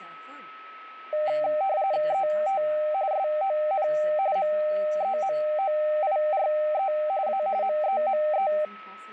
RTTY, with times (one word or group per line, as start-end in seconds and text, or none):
2.1-2.6 ET
3.1-3.9 SON
4.4-6.9 MEMOIRE
7.3-7.4 A
7.6-8.5 MEME